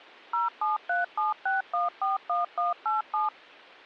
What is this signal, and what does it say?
DTMF, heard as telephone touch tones, dialled by machine, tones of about 150 ms. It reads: 07376141187